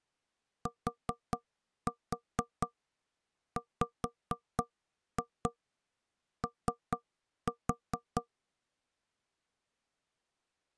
Tap code, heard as knocks on wood, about 4 knocks a second. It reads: TWO